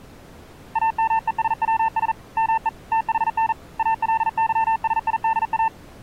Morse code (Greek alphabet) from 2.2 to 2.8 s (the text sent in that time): ΜΕ